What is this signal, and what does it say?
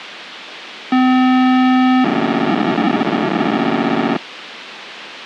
POCSAG pager data (512 baud), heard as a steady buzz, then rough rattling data, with radio hiss.